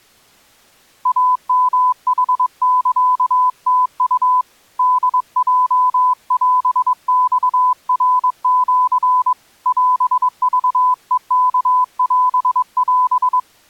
Morse code (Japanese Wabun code), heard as a keyed tone, hand-sent with a paddle, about 22 wpm, 1000 Hz. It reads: イヨヌサムウ ホヲオマナシ オクヘワオオ